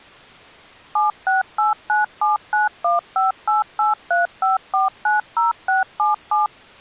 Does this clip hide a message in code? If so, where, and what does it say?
Yes: DTMF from 1.0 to 6.5 s, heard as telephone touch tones, dialled by machine, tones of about 150 ms. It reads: 768979158835490677